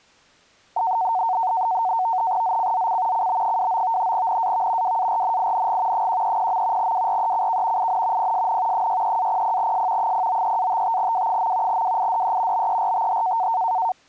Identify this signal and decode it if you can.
NAVTEX (SITOR-B), 100 baud, 170 Hz shift, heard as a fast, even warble, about 830 Hz centre. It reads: ZCZC CB29 NAV WARNING 130. WRECK IN PSN 63-00S 093-55W. WIDE BERTH